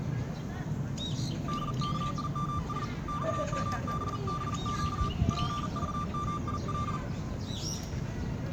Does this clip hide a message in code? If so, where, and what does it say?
Yes: Morse code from 1.4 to 7.0 s, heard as a keyed tone, hand-sent with a paddle, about 40 wpm, 1180 Hz, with room echo and the noise of a park. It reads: DKIMS XMBBQ PVMIL